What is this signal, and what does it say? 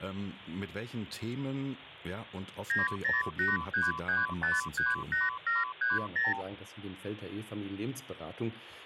Multi-frequency trunk signalling (R2, with the far end's replies), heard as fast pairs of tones, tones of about 170 ms. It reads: 90833538730